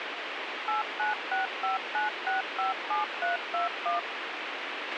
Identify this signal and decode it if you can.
DTMF, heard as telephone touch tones, dialled by machine, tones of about 140 ms, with radio hiss and a squelch burst at the end. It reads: 89659657321